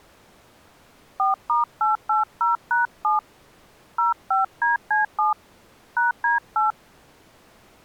DTMF, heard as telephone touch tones, dialled by hand, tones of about 140 ms. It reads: 4*880#7 05DC7 #D8